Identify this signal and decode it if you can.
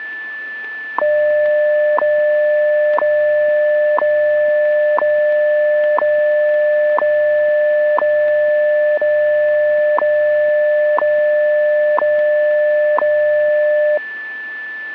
Radio time signal (WWV, Colorado), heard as ticks, one a second, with a steady whistle near 1750 Hz.